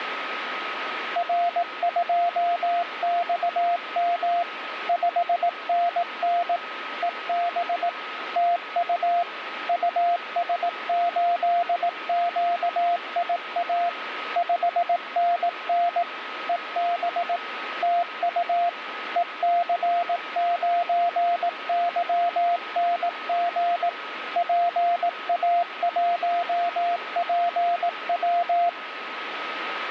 Morse code, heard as a keyed tone, machine-sent, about 18 wpm, 700 Hz, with radio static and a steady whistle near 1270 Hz. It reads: R2XM 5NN EB TU US8QIA 5NN EB TU EC9YNG PA1PW